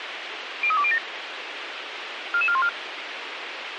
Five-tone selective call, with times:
0.6-1.0 03207
2.3-2.7 44414

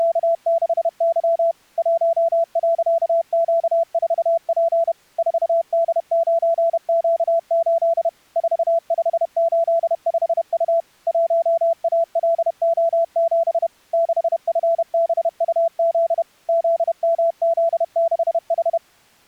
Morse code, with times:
0.0-1.5 …
1.8-4.9 1.Q4P
5.2-8.1 4D9Q8
8.4-10.8 4585U
11.1-13.7 1ALO7
13.9-16.2 6FBUZ
16.5-18.8 ZMZ6H

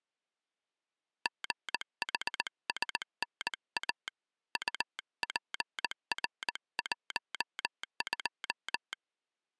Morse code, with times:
1.3-4.1 GHSNA
4.6-8.9 UPR12

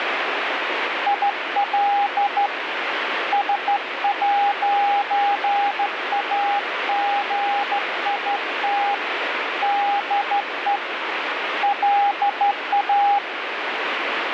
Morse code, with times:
1.1-2.5 IL
3.3-8.9 S'AGIT
9.6-10.8 DE
11.6-13.2 LA

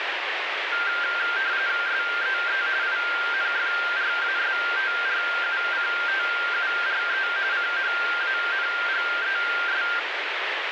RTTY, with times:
1.9-2.6 SEE
2.8-7.3 INFRASTRUCTURE
7.5-9.8 CHANGES

